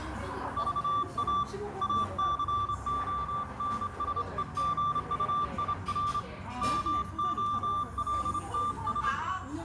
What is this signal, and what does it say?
Morse code, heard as a keyed tone, hand-sent with a straight key, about 27 wpm, 1180 Hz, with radio static, a narrow filter, room echo and the noise of a restaurant. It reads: VA ACONSEGUIR MOLTS